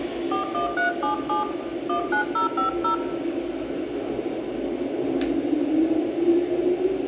DTMF, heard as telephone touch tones, dialled by hand, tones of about 120 ms, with room echo and the noise of a subway station. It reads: 41377 19050